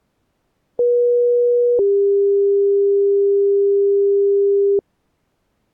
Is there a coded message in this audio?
Yes: two-tone page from 0.8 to 4.8 s, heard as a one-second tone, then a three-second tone, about 480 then 400 Hz.